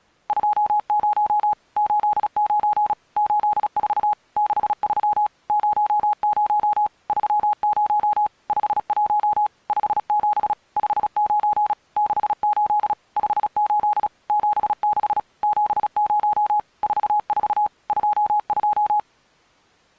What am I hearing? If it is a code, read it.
Morse code, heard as a keyed tone, machine-sent, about 36 wpm, 840 Hz. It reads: 20 89 84 63 00 30 51 57 59 68 58 76 70 44 22